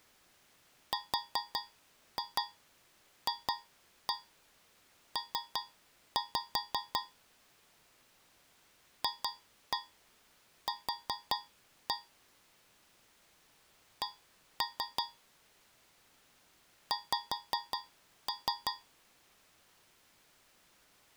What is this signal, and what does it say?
Tap code, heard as taps on a metal pipe, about 5 knocks a second. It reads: RFP FQ C X